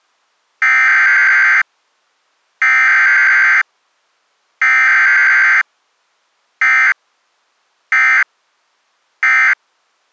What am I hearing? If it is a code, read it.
Emergency Alert System (SAME) tones (header bursts, then end-of-message bursts), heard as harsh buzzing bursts, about 520.83 baud.